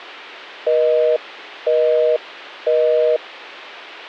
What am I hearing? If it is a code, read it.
Telephone call progress tone (North American plan), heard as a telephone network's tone, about 480, 620 Hz, 0.5 s on and 0.5 s off. Busy tone.